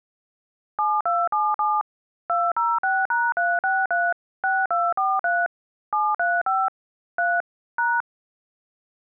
DTMF, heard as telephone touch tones, dialled by machine, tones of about 220 ms. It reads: 7277 206#363 6243 735 3 #